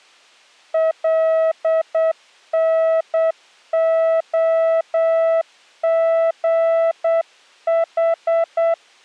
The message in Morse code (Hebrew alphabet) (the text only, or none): לנהגח